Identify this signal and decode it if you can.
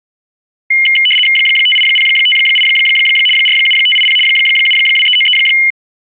RTTY (75 baud, 850 Hz shift), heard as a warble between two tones, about 2550 Hz centre. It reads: 58058 47580 72393